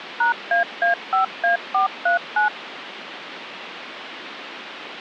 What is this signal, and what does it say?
DTMF, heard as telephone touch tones, dialled by machine, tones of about 120 ms, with phone line noise. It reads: #AA5A439